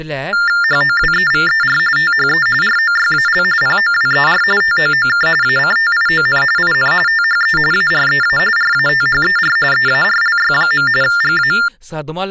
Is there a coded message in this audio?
Yes: TTY/TDD text telephone tones (45.45 baud Baudot) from 0.3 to 11.7 s, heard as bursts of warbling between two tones, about 400 Hz shift, 1600 Hz centre, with speech in Dogri. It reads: HOWEVER THE ROYAL POWER TOOK ACTION IN THE AREA RATHER EARLY. GA